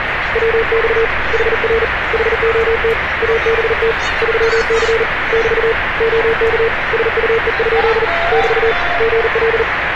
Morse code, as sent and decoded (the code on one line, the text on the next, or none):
.-- -..- / .... .-. / .... --- - / .- -... - / ...-- -.-. / -...- / --- -.- / ... ..- . ..--.. / -...- / --. .-..
WX HR HOT ABT 3C <BT> OK SUE? <BT> GL